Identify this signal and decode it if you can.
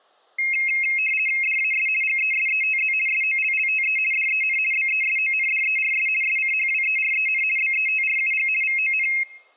RTTY (50 baud, 450 Hz shift), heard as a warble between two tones, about 2350 Hz centre, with room echo. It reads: DAS GESETZ SOLLTE DEN BESONDERS SCHWEREN BETRUG VON